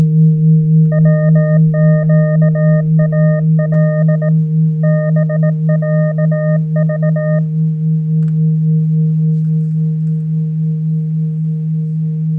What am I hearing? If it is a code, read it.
Morse code (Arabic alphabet), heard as a keyed tone, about 18 wpm, 610 Hz. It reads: وقال بعض